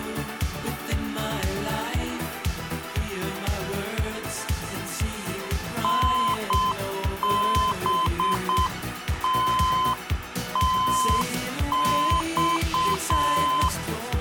Morse code (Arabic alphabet), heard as a keyed tone, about 7 wpm, 1030 Hz. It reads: نبتتص